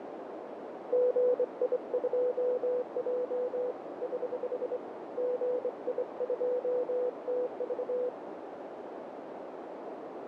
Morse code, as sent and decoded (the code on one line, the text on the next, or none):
--. .. ..--- .--- / ........ / --. .. ..--- - ...-
GI2J <HH> GI2TV